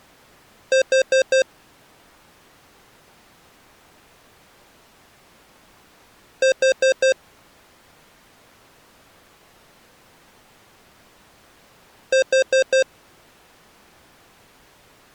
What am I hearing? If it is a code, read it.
Alarm pattern, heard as an alarm's beeps, played three times, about 530 Hz. Temporal four. Carbon monoxide.